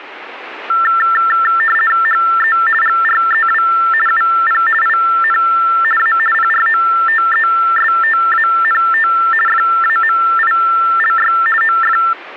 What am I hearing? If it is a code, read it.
RTTY (50 baud, 450 Hz shift), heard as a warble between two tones, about 1550 Hz centre. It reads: HE GREW UP IN A PROTESTANT FAMILY OF